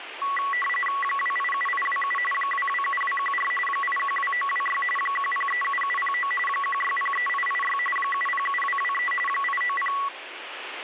RTTY (45.45 baud, 850 Hz shift), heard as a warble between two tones, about 1550 Hz centre, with radio static. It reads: 287827 227214 812926 1037709 1603886 707223 890